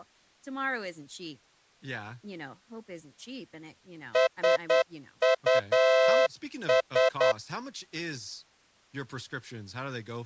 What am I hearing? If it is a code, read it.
Morse code, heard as a horn, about 9 wpm, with speech in English. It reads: SUS